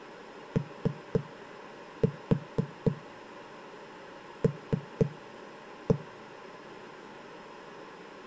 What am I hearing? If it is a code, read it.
Tap code, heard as knocks on a wall, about 4 knocks a second. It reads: OL